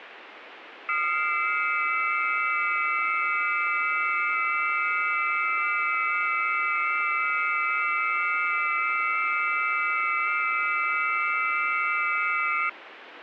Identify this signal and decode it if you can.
FT8 (several signals at once), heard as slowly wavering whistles, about 6.25 baud, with radio static.